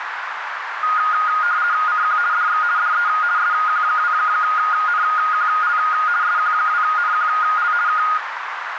RTTY (50 baud, 170 Hz shift), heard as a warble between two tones, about 1340 Hz centre, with radio static and a narrow filter. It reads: CQ DX DE SQ2NQL SQ2NQL K